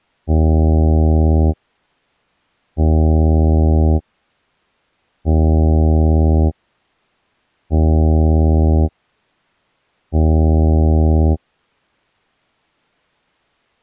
Ship horn signal, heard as a ship's horn, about 80 Hz. 5 short. At sea: I doubt that you are doing enough to avoid a collision.